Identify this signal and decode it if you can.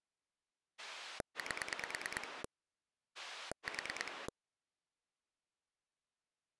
Pulse dialling, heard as a rotary dial, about 9 pulses a second. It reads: 8 4